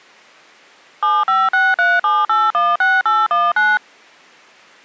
DTMF, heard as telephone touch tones, dialled by machine, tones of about 210 ms. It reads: 75637816819